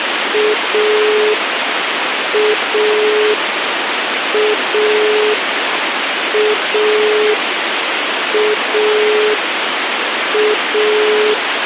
Telephone call progress tone (pulsed, as in Italy), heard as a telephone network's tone, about 420 Hz, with phone line noise. Dial tone.